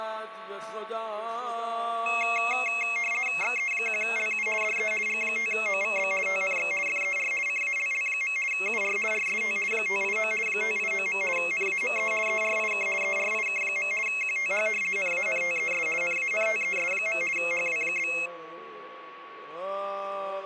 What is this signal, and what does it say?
RTTY (50 baud, 450 Hz shift), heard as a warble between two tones, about 2350 Hz centre, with a steady whistle near 1120 Hz. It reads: XE1LU DE G5OVB TNX FER CALL. UR RST 589 589. NAME ERIK ERIK. QTH NANTES NANTES. HW?